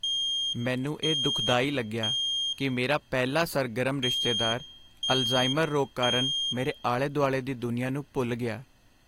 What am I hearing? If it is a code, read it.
Alarm pattern, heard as an alarm's beeps, played twice, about 3200 Hz, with room echo and speech in Punjabi. Temporal three. Smoke or fire, evacuate.